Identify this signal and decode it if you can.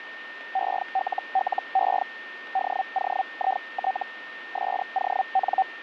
Hellschreiber (Feld-Hell, 122.5 baud), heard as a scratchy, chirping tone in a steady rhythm, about 770 Hz, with radio static and a steady whistle near 1820 Hz. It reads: ELLE DOIT SON